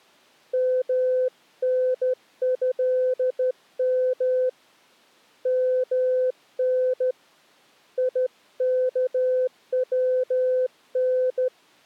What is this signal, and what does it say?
Morse code (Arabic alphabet), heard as a keyed tone, hand-sent with a straight key, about 13 wpm, 510 Hz. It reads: منهم من يكون